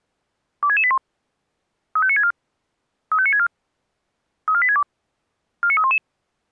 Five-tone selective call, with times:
0.6-1.0 26681
2.0-2.3 35964
3.1-3.5 35964
4.5-4.8 34862
5.6-6.0 49311

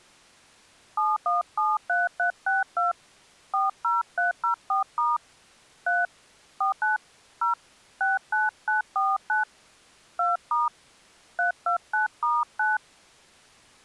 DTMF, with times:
1.0-2.9 7173362
3.5-5.2 40304*
5.9-6.1 3
6.6-7.0 49
7.4-7.5 0
8.0-9.4 69949
10.2-10.7 2*
11.4-12.8 329*9

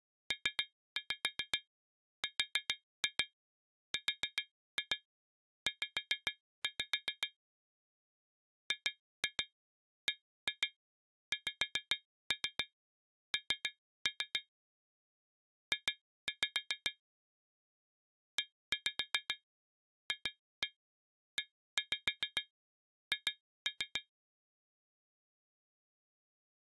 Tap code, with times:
0.3-7.3 PRRZ
8.7-14.4 GBXN
15.7-16.9 J
18.4-24.0 EFEH

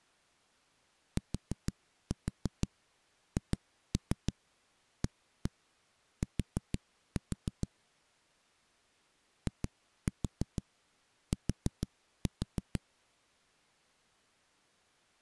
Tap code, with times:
1.2-7.7 THAT
9.5-12.8 IT

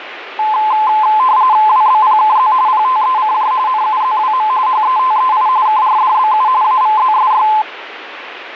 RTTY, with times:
1.7-2.5 WBPKZ
2.7-3.5 PTECJ
3.7-4.5 NUZWM
4.7-5.5 HETEI
5.7-6.5 KRDBU
6.6-7.5 AVZSY

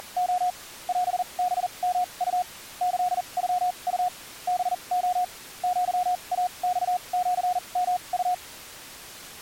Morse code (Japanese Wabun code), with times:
0.0-0.5 …
0.9-2.4 オハヨウ
2.8-4.1 キノウ
4.5-5.2 ハレ
5.6-8.3 アイマシヨウ

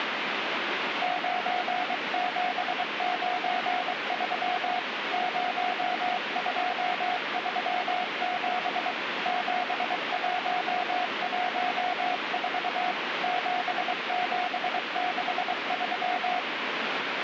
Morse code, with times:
1.0-4.8 9793
5.1-8.9 0237
9.3-12.9 7114
13.2-16.4 7763

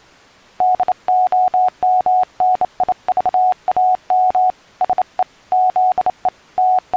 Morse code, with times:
0.6-4.5 DOMNIVAM
4.8-5.2 SE
5.5-6.3 ZE
6.6-7.0 …

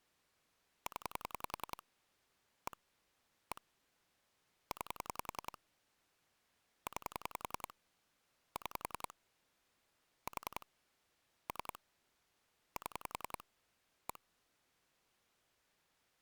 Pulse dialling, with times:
0.9-1.8 0
2.7-2.8 1
3.5-3.6 1
4.7-5.6 9
6.9-7.7 9
8.6-9.1 6
10.3-10.7 4
11.5-11.8 3
12.8-13.4 7
14.1-14.2 1

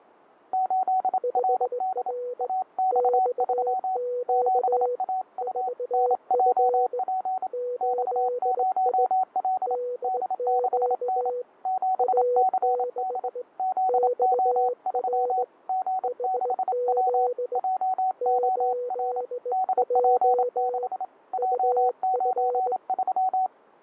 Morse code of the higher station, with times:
0.5-2.1 8RD
2.4-4.0 AX3
4.3-5.7 7AU
5.9-7.5 NJP
7.8-9.8 X0L
10.0-11.3 D6N
11.7-13.3 7CD
13.6-15.4 ZO3
15.7-17.3 G6W
17.6-19.2 JOR
19.5-21.0 DP6
21.3-23.5 J93

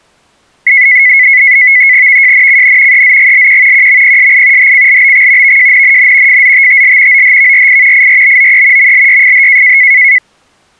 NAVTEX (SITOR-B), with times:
2.1-3.0 VJNCN
2.9-3.9 EZGLQ
3.7-4.7 QMPSI
4.6-5.6 HCLBX
5.4-6.4 VJNNN
6.3-7.2 FZTTL
7.1-8.1 OHVRI
7.9-8.9 IRBOE
8.8-9.8 MLYFH

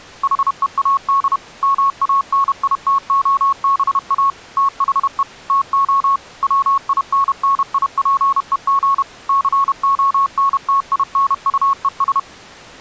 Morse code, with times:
0.2-1.4 HEAD
1.6-4.3 MANITOBA
4.6-5.2 THE
5.5-6.2 TO
6.4-9.0 WINNIPEG
9.3-12.2 CONTINUES

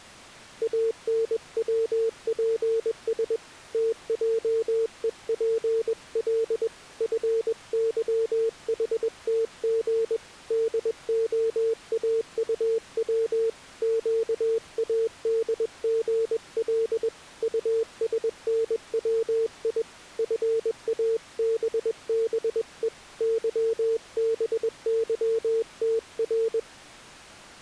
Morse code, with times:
0.6-3.4 ANWPS
3.7-6.7 TJEPL
7.0-10.2 FYHTG
10.5-13.5 DOAUW
13.8-17.1 QADGL
17.4-19.8 USNWI
20.2-22.9 FABBE
23.2-26.6 YBYTR

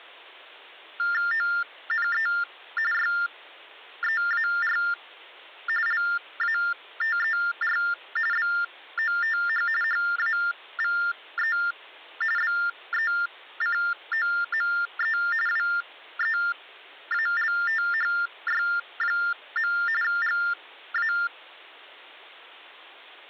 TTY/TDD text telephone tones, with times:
1.3-2.3 ONE
2.9-4.8 YEAR
5.9-7.8 LATER
8.3-9.7 BOTH
9.8-11.6 HAVE
12.4-15.2 BECOME
15.5-19.7 WEALTHY.
20.0-21.1 GA

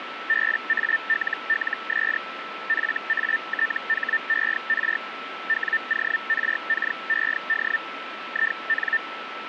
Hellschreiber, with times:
0.3-2.2 BALLS
2.7-5.0 FATHER
5.5-7.8 WORKED
8.3-9.0 IN

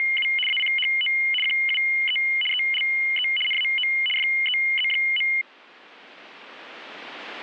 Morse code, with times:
none

